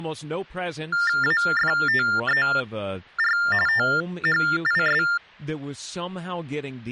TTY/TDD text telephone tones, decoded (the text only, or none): AFTER THIS